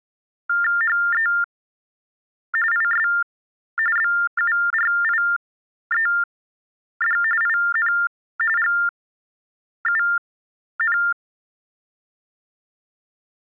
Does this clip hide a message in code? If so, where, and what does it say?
Yes: TTY/TDD text telephone tones (45.45 baud Baudot) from 0.5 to 13.4 s, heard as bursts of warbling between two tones, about 400 Hz shift, 1600 Hz centre. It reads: HE IS BURIED IN …